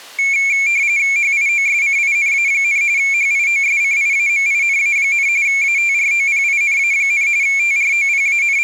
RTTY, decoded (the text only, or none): HIOSCINA, HIOSCIAMINA, ATROPINA, …